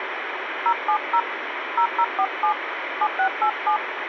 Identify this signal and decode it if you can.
DTMF, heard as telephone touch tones, dialled by hand, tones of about 80 ms, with radio hiss. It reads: 070 0047 7687